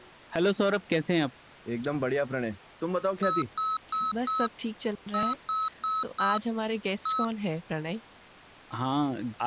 Beep code, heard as beeps from a small speaker, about 1290 Hz, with speech in English. 4-4-1. In Phoenix BIOS tables: serial port failure.